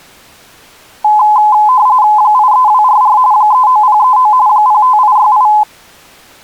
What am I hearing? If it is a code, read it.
RTTY (45.45 baud, 170 Hz shift), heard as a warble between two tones, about 930 Hz centre. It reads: 83244 39039 05868